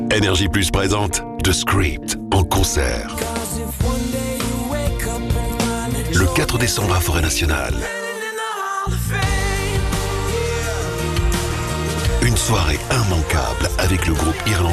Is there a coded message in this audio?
No.